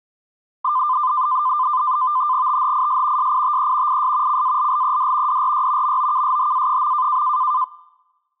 NAVTEX (SITOR-B), 100 baud, 170 Hz shift, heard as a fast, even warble, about 1110 Hz centre. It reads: THIS SITE IS CALLED DRY MOKSHA.